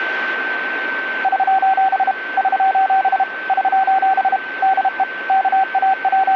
Morse code, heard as a keyed tone, machine-sent, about 32 wpm, 770 Hz, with radio static and a steady whistle near 1540 Hz. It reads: <SOS> <SOS> <SOS> DE …